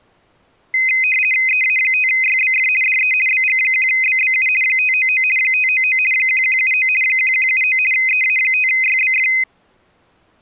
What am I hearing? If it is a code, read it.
RTTY (50 baud, 450 Hz shift), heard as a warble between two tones, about 2300 Hz centre. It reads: EA5YBF DE BG1BBU 599 599 1179 1179 EA5YBF